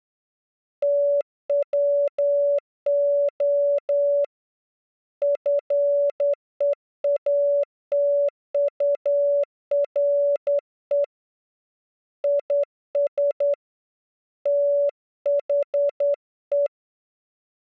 Morse code, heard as a keyed tone, hand-sent with a straight key, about 10 wpm, 570 Hz. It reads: TWO FEATURE IS THE